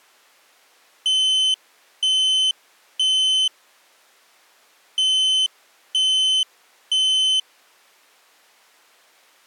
Alarm pattern, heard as an alarm's beeps, played twice, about 3050 Hz. Temporal three. Smoke or fire, evacuate.